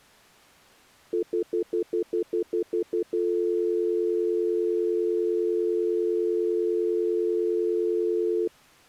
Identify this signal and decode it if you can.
Telephone call progress tone (North American plan), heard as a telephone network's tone, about 350, 440 Hz, 0.1 s on and 0.1 s off. Stutter dial tone.